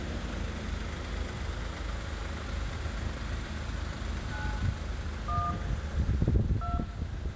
DTMF, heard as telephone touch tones, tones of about 230 ms, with room echo and street noise. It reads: 9 1 2